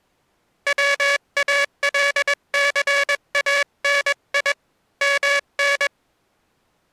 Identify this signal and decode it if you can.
Morse code (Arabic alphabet), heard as a buzzer, hand-sent with a paddle, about 21 wpm. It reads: والثاني من